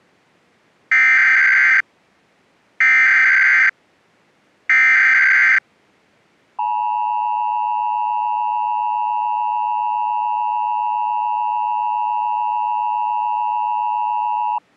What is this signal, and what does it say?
Emergency Alert System (SAME) tones (header bursts, then the 853 and 960 Hz attention tone), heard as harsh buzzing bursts, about 520.83 baud.